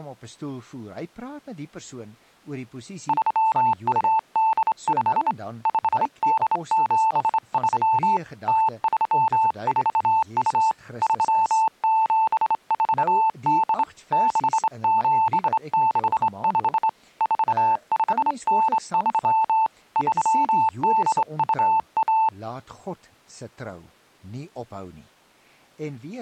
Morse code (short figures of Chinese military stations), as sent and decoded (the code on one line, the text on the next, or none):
...-- ..- -.. ..... / ..... -.. --... ...-- / - ...-- ....- ..- / ...-- --... ....- -.. / -.... --... -.... ..... / ....- ..... -. ...-- / ...-- -.. ..- .-
3285 5873 0342 3748 6765 4593 3821